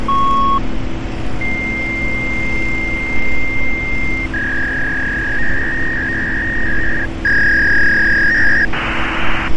Fax machine handshake, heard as a beep, a long tone, a warble and hiss, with phone line noise and street noise.